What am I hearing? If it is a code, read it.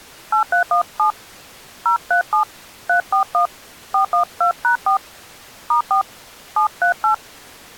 DTMF, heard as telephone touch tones, dialled by hand, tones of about 110 ms. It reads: 8317 037 341 412#4 *4 738